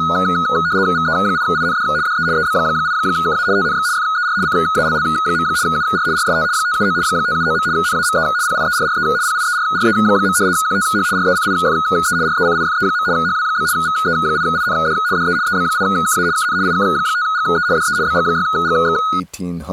RTTY (75 baud, 170 Hz shift), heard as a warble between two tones, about 1360 Hz centre, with speech in English. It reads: VE8IND DE EB8KA TNX FER CALL. UR RST 579 579. NAME PIERRE PIERRE. QTH RECIFE RECIFE. HW? VE8IND DE EB8KA KN IK5GE DE BG6GX